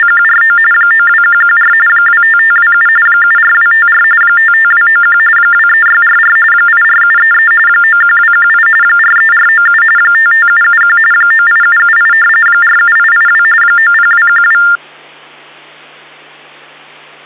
TTY/TDD text telephone tones (45.45 baud Baudot), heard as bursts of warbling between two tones, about 400 Hz shift, 1600 Hz centre, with hum. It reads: … 92114 25527 74254 55291 23644 84733 91218 43497 55771 98778 47882 90212